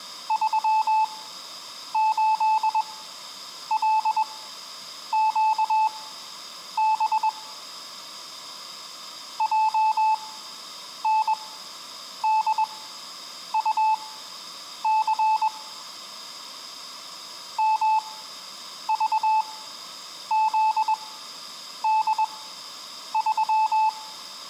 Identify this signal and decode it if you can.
Morse code, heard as a keyed tone, machine-sent, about 21 wpm, spaced as for 8 wpm, 870 Hz. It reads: 38LQB JNDUC MVZD3